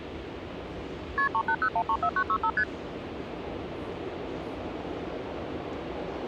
Multi-frequency trunk signalling (R1, as on North American trunks), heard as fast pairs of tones, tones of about 70 ms, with the noise of a subway station. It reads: KP 380134965 ST